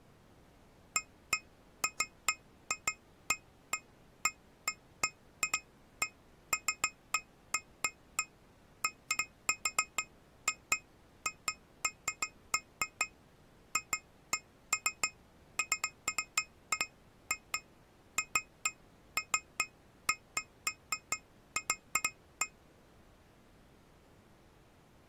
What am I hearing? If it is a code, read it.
Irregular taps on glass. There is no code.